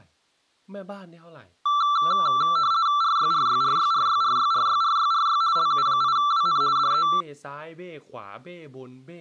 RTTY (50 baud, 170 Hz shift), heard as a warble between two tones, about 1250 Hz centre, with speech in Thai. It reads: RYRYRYRYRYRYRYRY LU8WN DE